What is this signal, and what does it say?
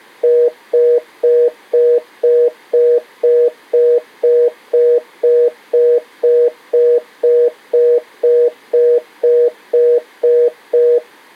Telephone call progress tone (North American plan), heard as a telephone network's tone, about 480, 620 Hz, 0.25 s on and 0.25 s off. Congestion tone.